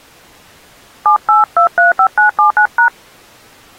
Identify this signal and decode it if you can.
DTMF, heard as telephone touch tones, dialled by hand, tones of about 120 ms. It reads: 78235979#